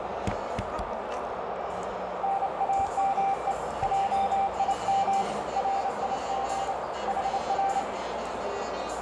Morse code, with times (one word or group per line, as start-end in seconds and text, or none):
2.2-3.5 NAME
3.8-5.2 JIM
5.6-6.7 RIG
7.1-7.8 HR